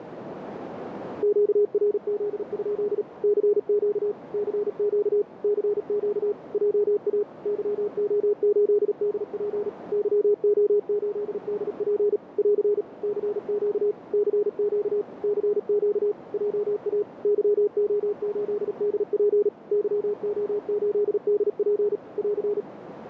Morse code, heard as a keyed tone, machine-sent, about 37 wpm, 410 Hz, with radio static and a narrow filter. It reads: QRZ? CQ CQ CQ JA YO8DP YO8DP <AR> CQ CQ CQ JA YO8DP YO8DP <AR>